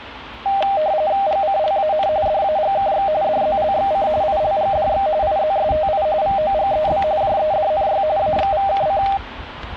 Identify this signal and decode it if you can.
RTTY (45.45 baud, 170 Hz shift), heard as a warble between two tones, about 700 Hz centre, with static crashes and street noise. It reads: GCLAN DAGKX DZLXC ILGDX IZSTI VOGEB JEDNY AXVKC